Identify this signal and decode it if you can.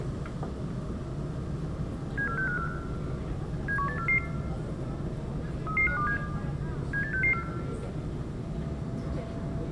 Five-tone selective call (CCIR), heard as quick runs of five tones, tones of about 100 ms, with room echo and the noise inside a subway train. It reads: 74654 71844 33527 78664